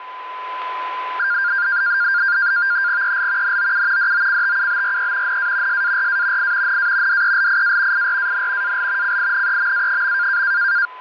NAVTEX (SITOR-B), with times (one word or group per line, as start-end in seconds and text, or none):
3.0-3.6 EL
3.4-4.1 NOU
4.0-5.4 DOCTUBRE
5.3-5.8 NA
5.7-6.5 SARA
6.4-6.8 I
6.7-7.2 NA
7.1-8.1 DELIA
7.9-8.8 IRAN
8.6-9.2 AL
9.0-10.4 CINEMA.